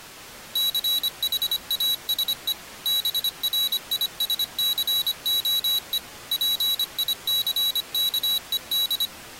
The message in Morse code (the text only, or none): CHASE BRISCOE PICKED